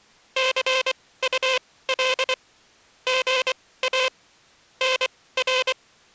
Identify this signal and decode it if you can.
Morse code, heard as a buzzer, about 24 wpm, spaced as for 17 wpm. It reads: CUL GA NR